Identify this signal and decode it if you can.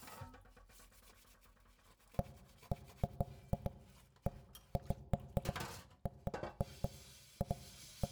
Irregular knocks on wood, with room echo and kitchen noise. There is no code.